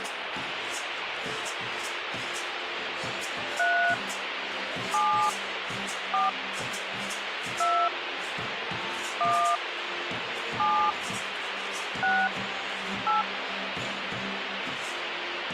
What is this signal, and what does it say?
DTMF, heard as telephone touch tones, dialled by hand, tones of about 250 ms, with radio hiss. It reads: 3 7 4 2 1 7 6 8